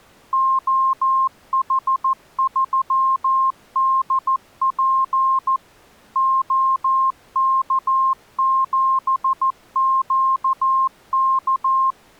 Morse code, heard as a keyed tone, machine-sent, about 14 wpm, 1060 Hz. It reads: OH3DP OK7QK